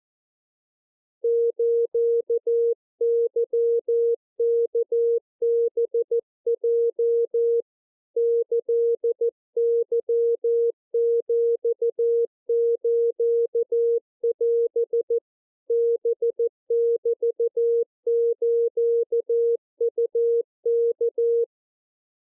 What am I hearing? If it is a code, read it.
Morse code (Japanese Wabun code), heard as a keyed tone, hand-sent with a paddle, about 14 wpm, 470 Hz. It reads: スケワハヲ キケヒスオ ハメスウワ